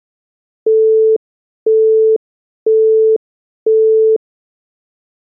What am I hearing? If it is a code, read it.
Telephone call progress tone (single-tone plan, as in Europe, Japan and elsewhere), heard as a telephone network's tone, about 440 Hz, 0.5 s on and 0.5 s off. Busy tone.